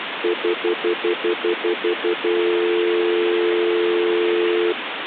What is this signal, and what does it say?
Telephone call progress tone (North American plan), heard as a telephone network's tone, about 350, 440 Hz, 0.1 s on and 0.1 s off, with phone line noise. Stutter dial tone.